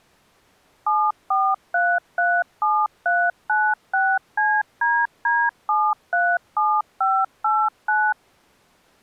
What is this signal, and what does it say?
DTMF, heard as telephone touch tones, dialled by machine, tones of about 240 ms. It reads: 74337396CDD737589